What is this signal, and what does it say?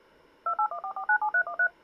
DTMF, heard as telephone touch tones, dialled by machine, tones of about 80 ms. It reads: 2814497313